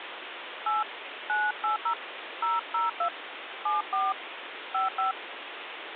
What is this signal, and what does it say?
DTMF, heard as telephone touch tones, dialled by hand, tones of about 150 ms, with phone line noise. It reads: 8 980 002 74 55